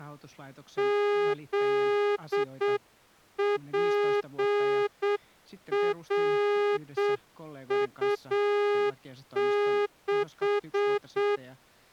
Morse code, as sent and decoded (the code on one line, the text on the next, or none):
--.. .--. .-. ..- -....
ZPRU6